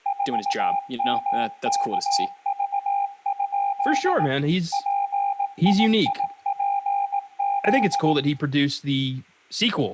Morse code, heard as a keyed tone, machine-sent, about 18 wpm, 800 Hz, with room echo and speech in English. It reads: 4MKV? PIIPZ